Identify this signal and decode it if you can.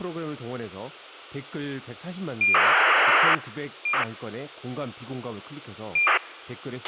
ACARS aircraft data, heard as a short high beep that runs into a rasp, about 2400 baud, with a squelch burst at the end and speech in Korean.